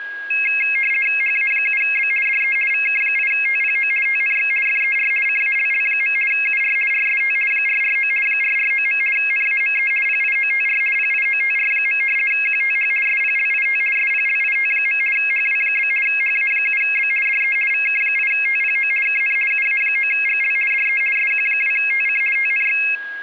RTTY (50 baud, 450 Hz shift), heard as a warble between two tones, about 2350 Hz centre, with a steady whistle near 1640 Hz. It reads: HA7B DE VK8TPO TNX FER CALL. UR RST 449 449. NAME PIOTR PIOTR. QTH SPLIT SPLIT. HW? HA7B DE VK8TPO KN UA9GL DE SQ2TC TNX